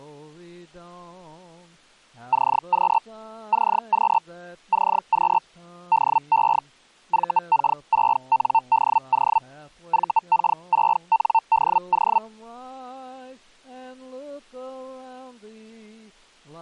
Hellschreiber (Feld-Hell, 122.5 baud), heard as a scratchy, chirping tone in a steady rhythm, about 900 Hz. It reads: CQ CQ CQ DE VK6NDO VK6NDO